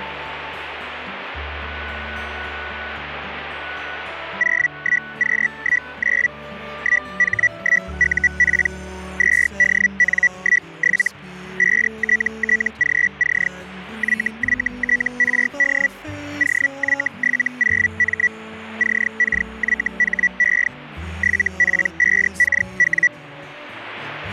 Hellschreiber (Feld-Hell, 122.5 baud), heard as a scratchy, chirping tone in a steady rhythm, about 1950 Hz. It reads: 01Q19 1H1UP 2DN17 5TTGC YYTRD OY70M CKYHE 7P5KW